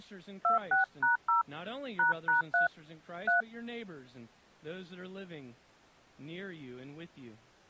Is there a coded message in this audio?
Yes: DTMF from 0.4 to 3.4 s, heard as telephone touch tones, dialled by hand, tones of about 130 ms, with speech in English. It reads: 26#0 ##3 3